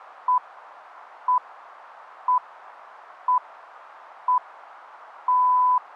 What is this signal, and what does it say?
Radio time signal (six pips, as the Greenwich Time Signal), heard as pips.